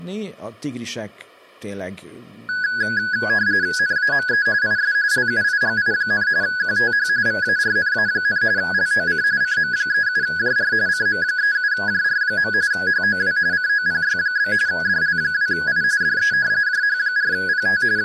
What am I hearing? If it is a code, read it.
RTTY (45.45 baud, 170 Hz shift), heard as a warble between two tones, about 1600 Hz centre, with speech in Hungarian. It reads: NAME IS LUIGI, QTH VARNA, LOC CM37JR CM37JR. HOW COPY? DL2I DE JH4PT …